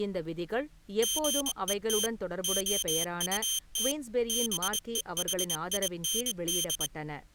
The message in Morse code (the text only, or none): GET OUT BEHIND